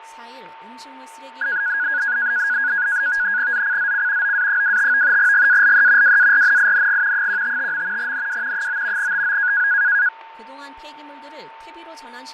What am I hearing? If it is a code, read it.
NAVTEX (SITOR-B), 100 baud, 170 Hz shift, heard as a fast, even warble, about 1550 Hz centre, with fading, a steady whistle near 900 Hz and speech in Korean. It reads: ZCZC OA25 GALE WARNING 155. NW 9 TO